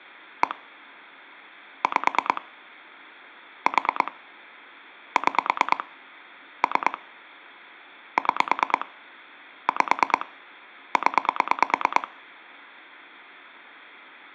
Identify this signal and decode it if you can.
Pulse dialling, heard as clicks on a phone line, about 9 pulses a second. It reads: 1 5 4 6 3 6 5 0